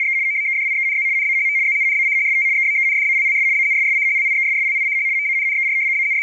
RTTY (75 baud, 170 Hz shift), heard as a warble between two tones, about 2200 Hz centre. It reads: … OBEDIENZ NAHM ZUNACHST EBENFALLS AUSSCHLIESSLICH MANNER …